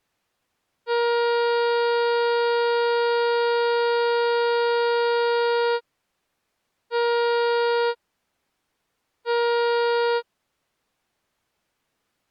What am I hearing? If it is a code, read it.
Ship horn signal, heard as a ship's horn, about 470 Hz. 1 long, 2 short. At sea: a vessel in fog that is sailing, fishing, towing or hampered.